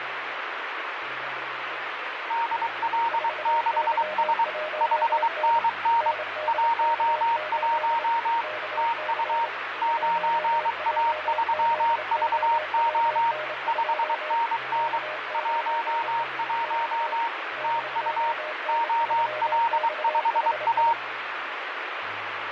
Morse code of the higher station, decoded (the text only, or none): DL6S 5NN 11 TU 9A3VO 5NN 11 TU OL5A